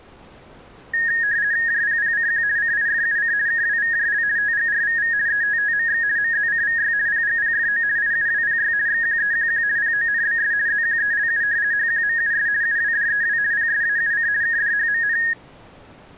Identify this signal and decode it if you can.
RTTY (50 baud, 170 Hz shift), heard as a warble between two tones, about 1750 Hz centre. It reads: JPPCQ CIFUC KWVJL TGRVV ETTMX MZCVY PGPFO IUWPY XQEQQ PONBS ZQELU HQMUS UWDEW PSAUC KDHMN